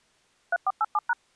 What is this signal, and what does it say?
DTMF, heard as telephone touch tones, dialled by machine, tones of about 40 ms. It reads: 3487#